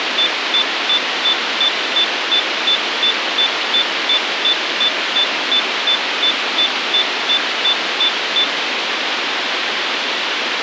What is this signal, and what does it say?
Evenly repeated beeps, with radio hiss. There is no code.